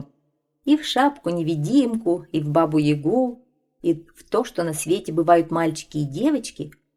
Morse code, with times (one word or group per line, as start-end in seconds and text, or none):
none